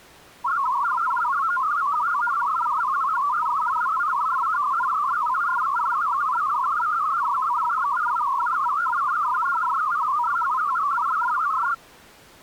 Multi-tone FSK (Olivia or MFSK type), about 500 Hz wide, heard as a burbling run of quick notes, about 62.5 baud.